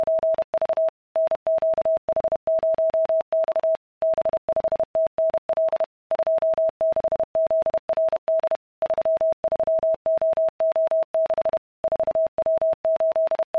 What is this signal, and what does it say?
Morse code, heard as a keyed tone, machine-sent, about 31 wpm, 650 Hz. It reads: … NQH0X B5TNL 26ZRD 33OO6 …